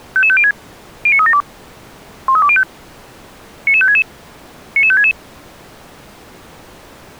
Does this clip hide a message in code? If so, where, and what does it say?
Yes: five-tone selective call (ZVEI) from 0.2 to 5.1 s, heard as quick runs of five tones, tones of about 70 ms. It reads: 55506 09372 13205 99566 99566